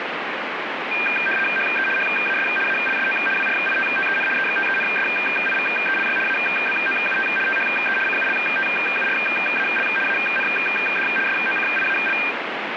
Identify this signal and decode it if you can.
RTTY (75 baud, 850 Hz shift), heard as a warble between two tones, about 2000 Hz centre, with radio static. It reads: HE HAS ALSO WRITTEN EXTENSIVELY ABOUT THE CULTURAL AND SOCIAL